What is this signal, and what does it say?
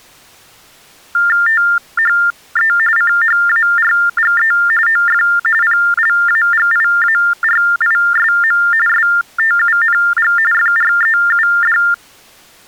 TTY/TDD text telephone tones (45.45 baud Baudot), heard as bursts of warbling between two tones, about 400 Hz shift, 1600 Hz centre. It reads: THE CHARGE OF PLAGIARISM STUNG FREUD